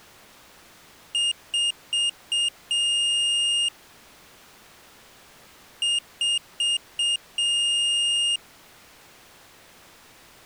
Beep code, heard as a piezo beeper, played twice, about 2850 Hz. 4 short, 1 long.